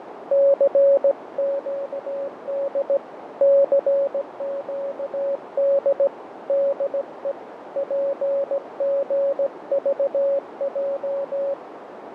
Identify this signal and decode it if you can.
Morse code, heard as a keyed tone, hand-sent with a straight key, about 17 wpm, 560 Hz, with radio static, fading and a narrow filter. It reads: CQD CQD DE PGVJ